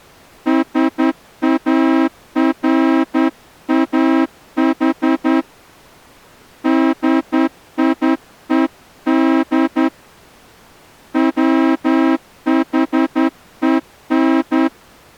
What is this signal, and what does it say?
Morse code, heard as a horn, hand-sent with a straight key, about 10 wpm. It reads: SARAH DIED WHEN